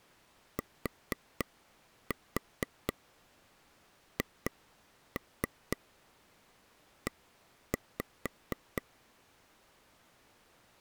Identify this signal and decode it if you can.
Tap code, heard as taps on a table, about 4 knocks a second. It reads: THE